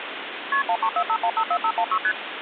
Multi-frequency trunk signalling (R1, as on North American trunks), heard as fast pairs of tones, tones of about 70 ms, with phone line noise. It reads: KP 1345154516 ST